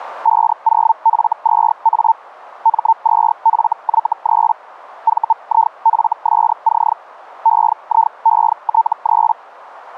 Hellschreiber (Feld-Hell, 122.5 baud), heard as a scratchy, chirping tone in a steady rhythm, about 900 Hz. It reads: 50F2A M2FY3 VIFSC EIET3